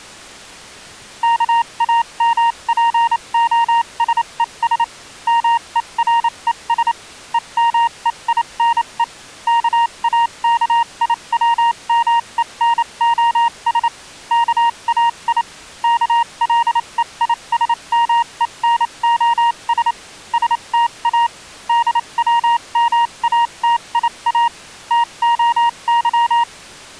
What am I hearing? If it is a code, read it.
Morse code (Greek alphabet), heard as a keyed tone, machine-sent, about 28 wpm, spaced as for 24 wpm, 940 Hz. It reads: ΚΑΜΠΟΣΕΣ ΜΕΡΕΣ ΕΜΕΙΝΕ ΚΑΚΙΩΜΕΝΟΣ ΚΑΙ ΚΛΕΙΣΜΕΝΟΣ ΣΤΑ ΔΩΜΑΤΙΑ ΤΟΥ